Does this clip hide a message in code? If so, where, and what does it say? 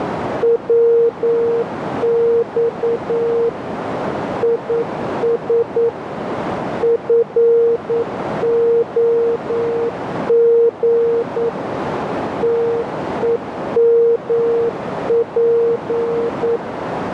Yes: Morse code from 0.4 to 16.6 s, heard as a keyed tone, machine-sent, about 9 wpm, 460 Hz, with radio static and a narrow filter. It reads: WX IS FOG TEMP